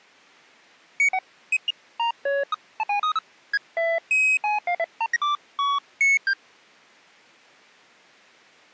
Electronic bleeps of random pitch and length. There is no code.